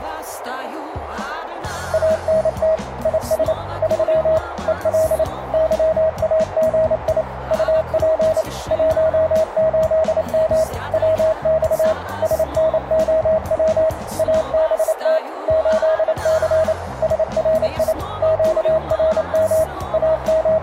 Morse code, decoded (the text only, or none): ANT IS 3 EL YAGI UP 18M WX SNOW ABT 8C SRI QRM …